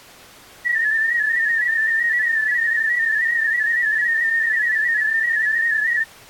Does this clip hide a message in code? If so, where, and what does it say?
Yes: multi-tone FSK (Olivia or MFSK type), about 250 Hz wide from 0.6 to 6.1 s, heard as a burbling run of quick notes, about 31.25 baud.